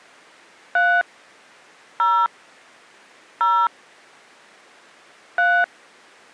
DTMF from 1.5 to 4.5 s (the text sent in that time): 0 0